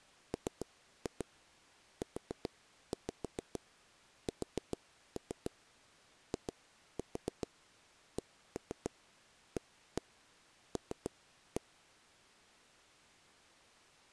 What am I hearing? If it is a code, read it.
Tap code, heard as taps on a table, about 7 knocks a second. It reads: MUSICAL